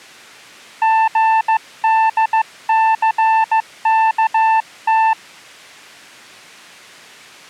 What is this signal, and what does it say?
Morse code, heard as a keyed tone, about 15 wpm, 890 Hz. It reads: GDCKT